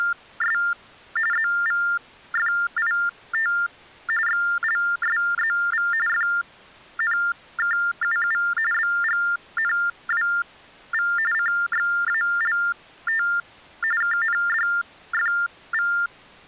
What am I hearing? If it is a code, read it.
TTY/TDD text telephone tones (45.45 baud Baudot), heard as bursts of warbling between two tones, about 400 Hz shift, 1600 Hz centre. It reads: … ZVFIT XLSZV FNKUU BGNWV CXALT KNDFV